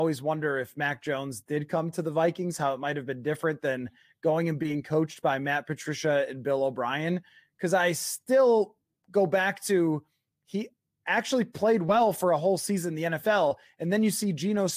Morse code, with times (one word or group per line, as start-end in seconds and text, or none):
none